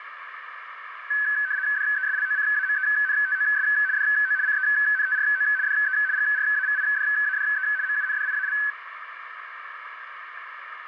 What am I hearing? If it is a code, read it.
RTTY (75 baud, 170 Hz shift), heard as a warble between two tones, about 1600 Hz centre, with radio static and a narrow filter. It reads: DESLOCAMENTOS DO CENTRO DE GRAVIDADE MUNDIAL